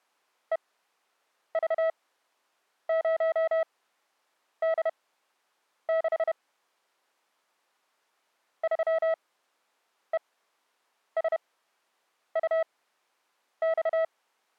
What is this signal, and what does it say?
Morse code, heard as a keyed tone, machine-sent, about 31 wpm, spaced as for 8 wpm, 650 Hz. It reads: EV0D6 3ESUX